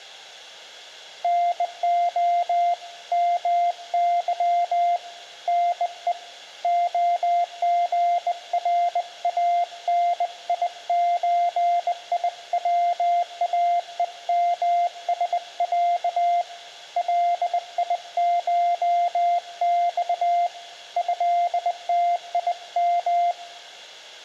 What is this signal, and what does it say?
Morse code (Russian alphabet), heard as a keyed tone, hand-sent with a bug key, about 20 wpm, 700 Hz, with room echo. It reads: НО МЫ НЕ ОГРАНИЧИВАЕМСЯ ЛИШЬ ЭТИМ